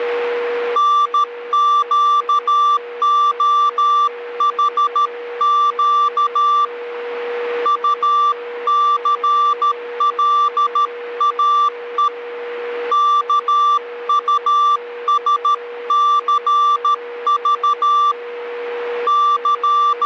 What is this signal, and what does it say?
Morse code, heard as a keyed tone, hand-sent with a paddle, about 13 wpm, 1170 Hz, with a steady whistle near 480 Hz. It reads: NQOHQ UCLAE KUSCV …